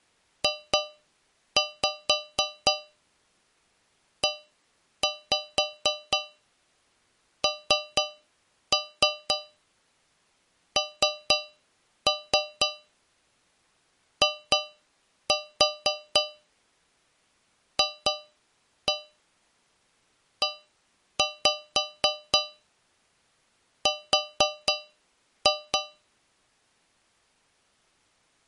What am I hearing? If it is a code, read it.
Tap code, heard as taps on a metal pipe, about 4 knocks a second. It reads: JENNIFER